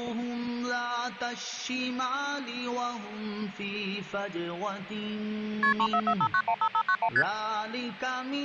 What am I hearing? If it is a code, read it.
Multi-frequency trunk signalling (R1, as on North American trunks), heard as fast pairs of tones, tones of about 70 ms. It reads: KP 3445915591 ST